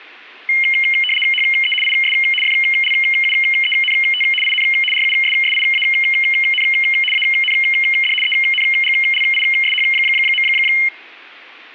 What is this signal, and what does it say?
RTTY (75 baud, 850 Hz shift), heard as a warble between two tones, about 2550 Hz centre. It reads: HE IS FLUENT IN RUSSIAN AND ENGLISH.